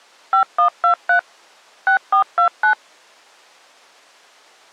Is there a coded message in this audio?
Yes: DTMF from 0.3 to 2.7 s, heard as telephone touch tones, dialled by machine, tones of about 100 ms. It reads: 5123 6429